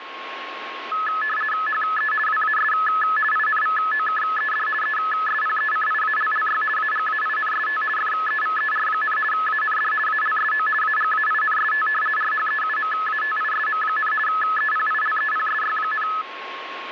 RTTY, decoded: HE WAS INVOKED ESPECIALLY AGAINST FEVER, AND ALSO AGAINST RHEUMATISM, EPILEPSY,

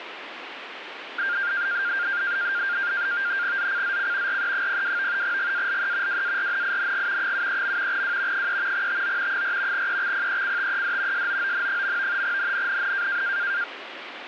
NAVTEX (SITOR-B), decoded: ZCZC RE02 GALE WARNING 73. W 3 TO 4 EXPECTED SOON. NNNN

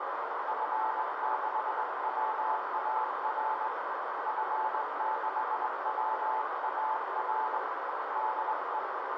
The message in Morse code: F6WAR F6WAR DE

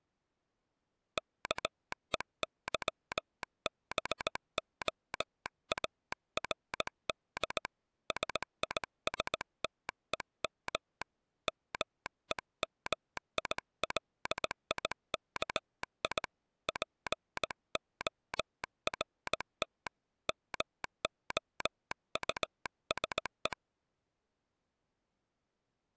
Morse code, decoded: KEYBOARD SISTEM MEMILIKI PORT MOUSE

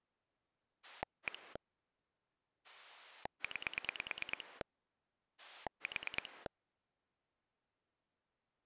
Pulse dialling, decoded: 1 9 4

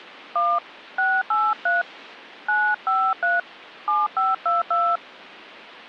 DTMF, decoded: 1 683 953 7522

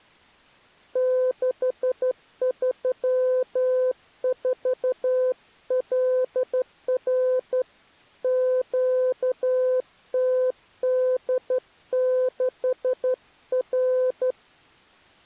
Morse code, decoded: 634LR QTD6R

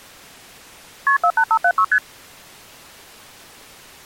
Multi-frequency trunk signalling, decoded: KP 48576 ST

